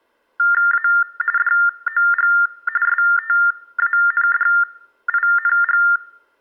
TTY/TDD text telephone tones (45.45 baud Baudot), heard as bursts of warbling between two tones, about 400 Hz shift, 1600 Hz centre. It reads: A DOG STANDING